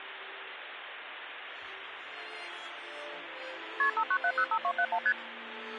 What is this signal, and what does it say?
Multi-frequency trunk signalling (R1, as on North American trunks), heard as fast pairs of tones, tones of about 70 ms, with phone line noise. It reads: KP 59705271 ST